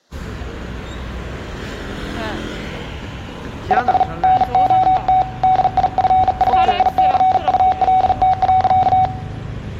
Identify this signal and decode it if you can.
Morse code, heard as a keyed tone, hand-sent with a bug key, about 40 wpm, 750 Hz, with room echo and street noise. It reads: IS NOT DIFFICULT.